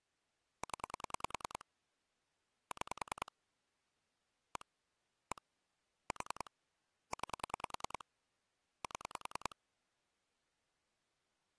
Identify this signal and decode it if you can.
Pulse dialling, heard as clicks on a phone line, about 10 pulses a second. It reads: 0 6 1 1 4 9 7